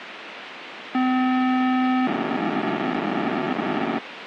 POCSAG pager data (512 baud), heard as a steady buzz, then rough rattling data, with radio hiss.